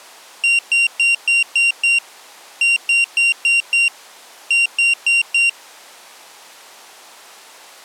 Beep code, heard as a piezo beeper, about 2750 Hz. 6-5-4.